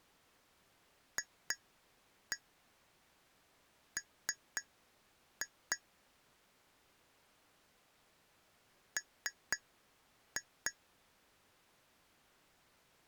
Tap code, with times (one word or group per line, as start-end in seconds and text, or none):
1.2-5.8 FM
9.0-10.7 M